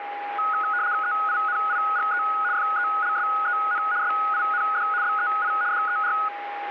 RTTY (75 baud, 170 Hz shift), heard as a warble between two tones, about 1360 Hz centre, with radio static and a steady whistle near 820 Hz. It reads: EINIGE FELSEN SIND BEI DER